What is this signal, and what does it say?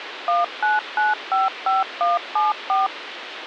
DTMF, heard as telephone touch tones, dialled by machine, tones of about 170 ms, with radio hiss. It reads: 19955174